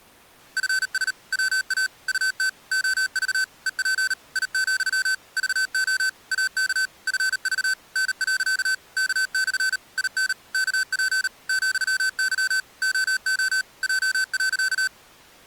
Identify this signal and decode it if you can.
Morse code, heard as electronic beeps, machine-sent, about 38 wpm, 1550 Hz. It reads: FS WA UT OV EP I, VO AK FV N. K/ IN KP ,Y OO J.